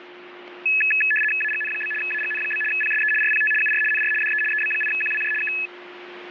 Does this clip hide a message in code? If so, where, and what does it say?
Yes: RTTY (75 baud, 850 Hz shift) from 0.7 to 5.7 s, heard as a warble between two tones, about 2150 Hz centre, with radio static and a steady whistle near 360 Hz. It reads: AGN? AGN? PSE RPT UR NR DE EB8QWJ K